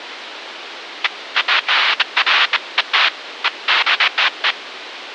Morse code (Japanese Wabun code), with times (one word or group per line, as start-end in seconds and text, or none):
none